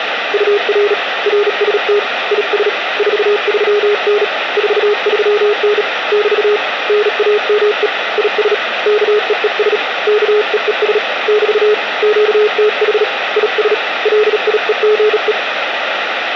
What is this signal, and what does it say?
Morse code, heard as a keyed tone, hand-sent with a bug key, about 37 wpm, 420 Hz, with radio static. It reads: UR RST IS 43N 43N <BT> NAME IS KEES KEES <BT> QTH IS LIEGE